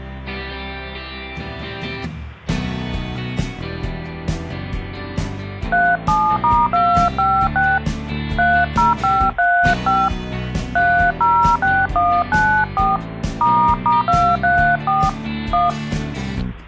DTMF, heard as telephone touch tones, dialled by hand, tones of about 250 ms. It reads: 37*256 30535 306194 **234 1